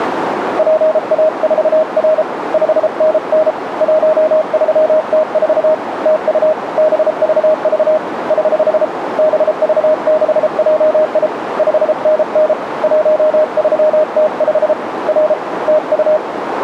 Morse code, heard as a keyed tone, hand-sent with a paddle, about 33 wpm, 620 Hz, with radio static and a narrow filter. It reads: PA4R 5NN 13T4 TU BVV <HH> BV6JI 5NN 13T5 R TU